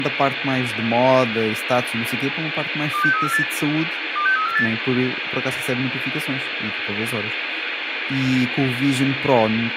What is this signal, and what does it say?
Five-tone selective call (CCIR), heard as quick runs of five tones, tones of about 100 ms, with radio hiss, room echo and speech in Portuguese. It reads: 26348 26348